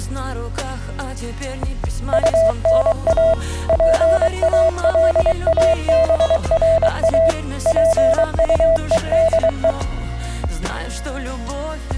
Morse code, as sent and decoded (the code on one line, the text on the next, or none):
..- -. .- / .--. .- .-.. .- -... .-. .- / .--. ..- . -.. .
UNA PALABRA PUEDE